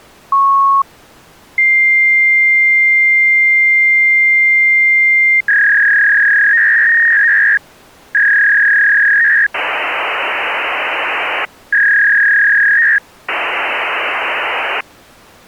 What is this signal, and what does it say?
Fax machine handshake, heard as a beep, a long tone, a warble and hiss.